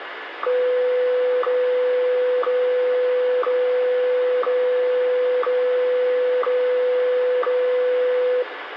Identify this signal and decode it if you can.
Radio time signal (WWVH, Hawaii), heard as ticks, one a second, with radio static and room echo.